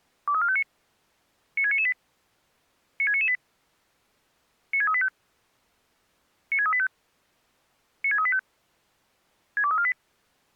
Five-tone selective call (ZVEI), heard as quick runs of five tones, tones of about 70 ms. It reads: 23459 96998 96998 96385 96385 96385 62348